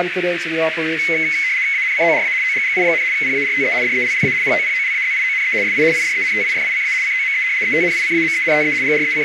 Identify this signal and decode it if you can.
RTTY (75 baud, 170 Hz shift), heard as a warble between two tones, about 2150 Hz centre, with radio static and a narrow filter. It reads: ANCORA OGGI, PARTE DELLA POPOLAZIONE SI IDENTIFICA COME ETNICAMENTE …